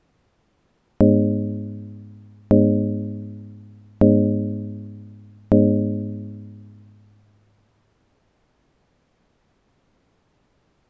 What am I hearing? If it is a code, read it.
Clock strike, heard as a bell. 4. Four o'clock.